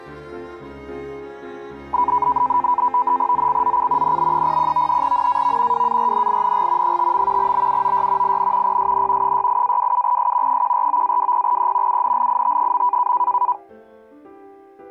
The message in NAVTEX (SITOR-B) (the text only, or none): ZCZC NB01 NAV WARNING 5. BUOY IN PSN 68-27S 149-20E UNLIT.